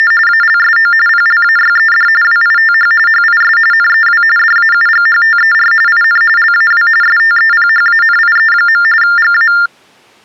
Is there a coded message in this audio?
Yes: TTY/TDD text telephone tones (45.45 baud Baudot) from 0.0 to 9.7 s, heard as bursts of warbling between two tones, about 400 Hz shift, 1600 Hz centre. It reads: … ALSO PLAYED WITH HIS NEW DAUGHTER IN LAW STEPHANIE. GA